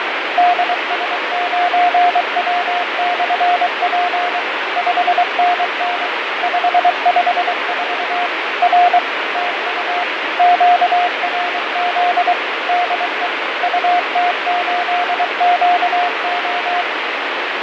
Morse code, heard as a keyed tone, machine-sent, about 23 wpm, 710 Hz, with heavy radio static and fading. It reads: DS9W/P 5NN 554 R TU QRZ DE UT8QO